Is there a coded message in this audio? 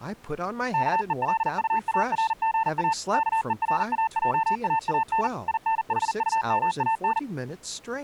Yes: Morse code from 0.7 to 7.3 s, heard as a keyed tone, machine-sent, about 40 wpm, 890 Hz, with speech in English. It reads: KELUARGA KERAJAAN INHUMAN